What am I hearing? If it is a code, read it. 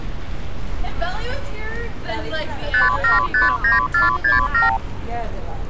Multi-frequency trunk signalling (R2, with the far end's replies), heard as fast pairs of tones, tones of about 150 ms, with street noise. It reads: 5759467